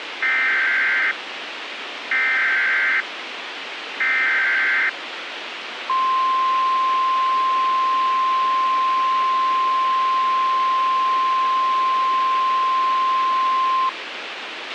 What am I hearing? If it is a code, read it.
Emergency Alert System (SAME) tones (header bursts, then the 1050 Hz attention tone), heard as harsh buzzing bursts, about 520.83 baud, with radio hiss and a squelch burst at the end.